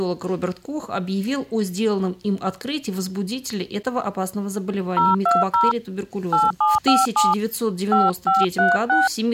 DTMF, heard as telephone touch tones, dialled by hand, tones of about 180 ms. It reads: 020 8757 5536